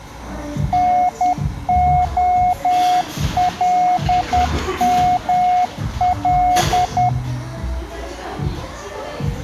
Morse code, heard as a keyed tone, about 10 wpm, 720 Hz, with the noise of a cafe. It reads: NOLML